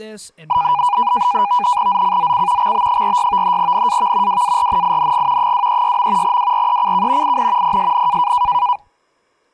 NAVTEX (SITOR-B), 100 baud, 170 Hz shift, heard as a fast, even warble, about 900 Hz centre, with speech in English. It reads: ZCZC XB46 NAV WARNING 236. WRECK IN PSN